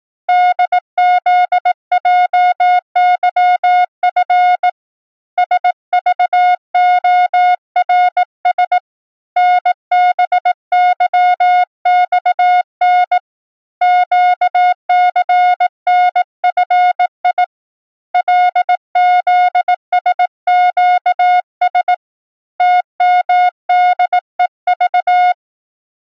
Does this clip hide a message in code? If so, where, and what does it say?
Yes: Morse code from 0.2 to 25.4 s, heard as a keyed tone, hand-sent with a bug key, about 18 wpm, 720 Hz. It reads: DZJYF SVORS NBYXN QCNFI LZSQS TMDEV